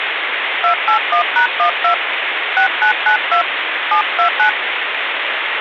DTMF, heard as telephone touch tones, dialled by hand, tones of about 100 ms, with phone line noise. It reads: 281#12 6992 729